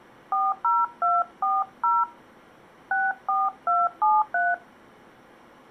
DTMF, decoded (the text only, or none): 40240 64273